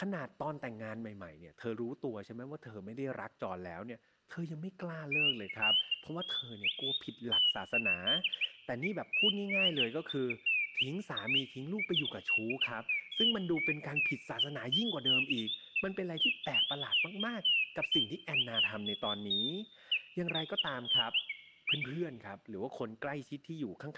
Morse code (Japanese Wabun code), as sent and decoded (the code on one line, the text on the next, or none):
none